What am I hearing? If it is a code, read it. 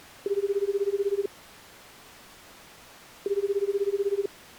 Telephone call progress tone (Japanese plan), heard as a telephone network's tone, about 380, 400, 420 Hz, 1 s on and 2 s off. Ringback tone.